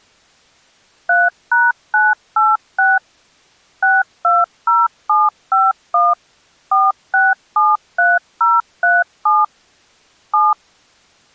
DTMF, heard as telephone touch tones, dialled by machine, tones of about 200 ms. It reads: 3#986 620751 4673037 7